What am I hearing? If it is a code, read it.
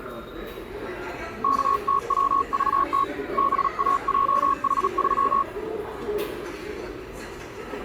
Morse code, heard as a keyed tone, hand-sent with a paddle, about 37 wpm, 1100 Hz, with the noise of a subway station. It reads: KTWVT BAJH3